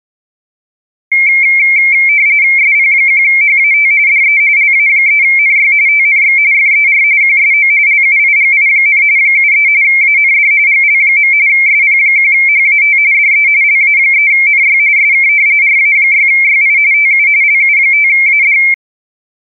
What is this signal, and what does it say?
RTTY (45.45 baud, 170 Hz shift), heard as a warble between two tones, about 2250 Hz centre. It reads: SP1HAT DE LA3NY TNX FER QSO LUIGI, 73 AND GL. SP1HAT DE LA3NY SK RA6YI TU LU5AD